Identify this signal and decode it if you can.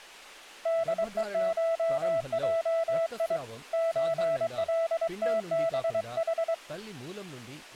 Morse code (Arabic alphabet), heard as a keyed tone, hand-sent with a paddle, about 23 wpm, 660 Hz, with speech in Telugu. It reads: دءشجي زلتبح